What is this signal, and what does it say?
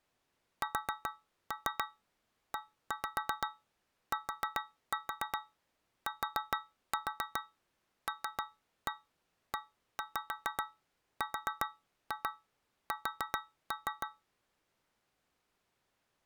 Tap code, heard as taps on a metal pipe, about 7 knocks a second. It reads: SETTLERS